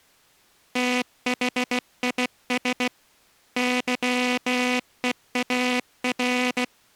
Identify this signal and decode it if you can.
Morse code, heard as a buzzer, hand-sent with a bug key, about 16 wpm. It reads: THIS YEAR